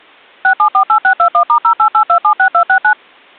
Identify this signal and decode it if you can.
DTMF, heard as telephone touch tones, dialled by machine, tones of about 90 ms. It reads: 6748621*088276269